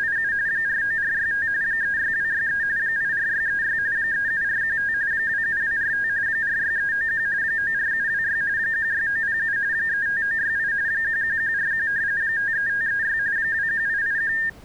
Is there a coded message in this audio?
Yes: RTTY (45.45 baud, 170 Hz shift) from 0.0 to 14.5 s, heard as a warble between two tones, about 1700 Hz centre. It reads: … 49465 36263 84636 37415 27245 46391 94726 16907 35968 11141 53536 21881